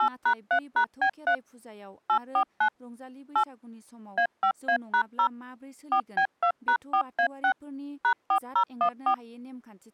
DTMF, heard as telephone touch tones, dialled by machine, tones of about 80 ms, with speech in Bodo. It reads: 8#3#B3 849 8 A5A#0 4B2#4A6 #4014